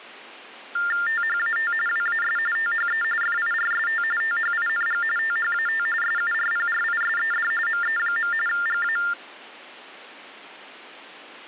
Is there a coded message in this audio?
Yes: TTY/TDD text telephone tones (45.45 baud Baudot) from 0.8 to 9.1 s, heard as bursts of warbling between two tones, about 400 Hz shift, 1600 Hz centre. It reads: THAT WAS THE FIRST THING THAT SURPRISED ME. GA